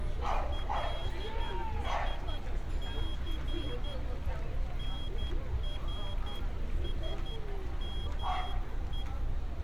Morse code (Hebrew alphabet), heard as a high beeper, hand-sent with a straight key, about 11 wpm, 3300 Hz, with street noise. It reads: לשס נרשמו